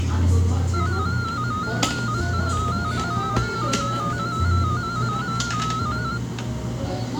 Multi-tone FSK (Olivia or MFSK type), about 250 Hz wide, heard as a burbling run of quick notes, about 15.625 baud, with the noise of a cafe.